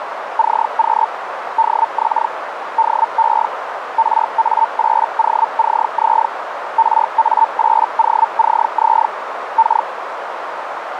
Hellschreiber (Feld-Hell, 122.5 baud), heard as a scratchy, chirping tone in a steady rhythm, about 900 Hz, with radio static and a narrow filter. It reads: CQ DX DE RA8OCZ RA8OCZ K